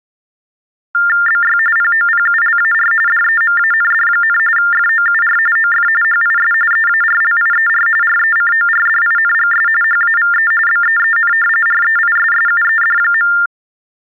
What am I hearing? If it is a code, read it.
TTY/TDD text telephone tones (45.45 baud Baudot), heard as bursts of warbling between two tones, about 400 Hz shift, 1600 Hz centre. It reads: BY POPULAR DEMAND, FOUR OF HIS EARLIER RECORDINGS HAVE BEEN REISSUED.